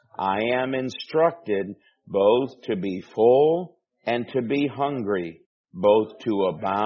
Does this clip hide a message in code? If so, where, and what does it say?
No.